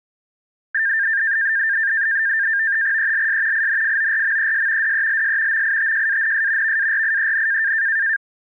NAVTEX (SITOR-B), 100 baud, 170 Hz shift, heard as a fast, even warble, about 1700 Hz centre. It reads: ELS INFORMES DELS MITJANS VARIEN